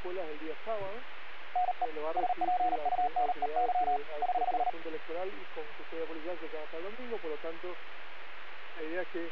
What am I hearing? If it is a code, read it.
Morse code, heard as a keyed tone, hand-sent with a paddle, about 38 wpm, 730 Hz. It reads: NE SPUNEY <HH>